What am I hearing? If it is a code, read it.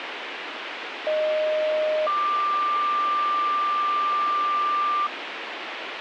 Two-tone page, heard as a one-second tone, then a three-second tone, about 620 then 1180 Hz, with radio hiss.